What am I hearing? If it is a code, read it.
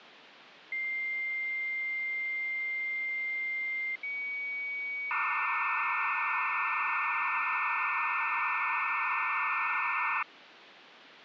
Dial-up modem handshake (low-speed, two carriers), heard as two whistles, then hiss, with phone line noise.